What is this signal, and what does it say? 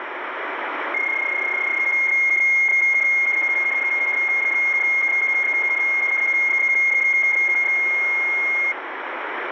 PSK31 (31.25 baud), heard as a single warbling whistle, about 2150 Hz, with radio static.